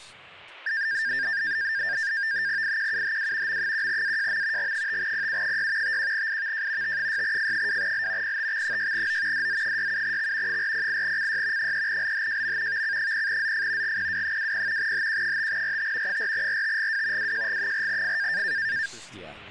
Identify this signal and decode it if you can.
NAVTEX (SITOR-B), 100 baud, 170 Hz shift, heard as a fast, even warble, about 1700 Hz centre, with speech in English. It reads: IQUHW M1AJM G5PU6 51IVJ T6F2L PTX6O DZ67X 408CY 3LHJM VC0ZF GPW20 HQ5RT 4RTGW WJG4F